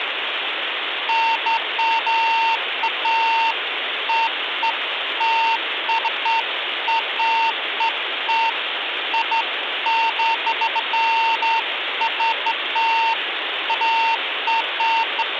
Beeps of irregular length, with phone line noise. There is no code.